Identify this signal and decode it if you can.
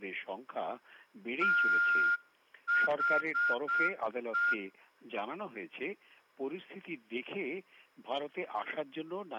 Morse code, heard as a whistle, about 7 wpm, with room echo. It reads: THE